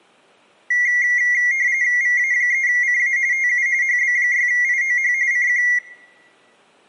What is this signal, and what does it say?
RTTY (45.45 baud, 170 Hz shift), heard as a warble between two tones, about 2050 Hz centre, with room echo. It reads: VA3CA TU HB6IOH CQ